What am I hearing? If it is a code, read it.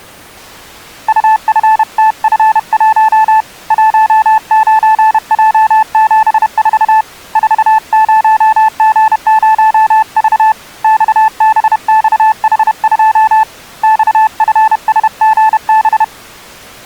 Morse code, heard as a keyed tone, hand-sent with a paddle, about 31 wpm, 870 Hz. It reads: UFTF1 19J74 40G0V XBXH2 XFSGB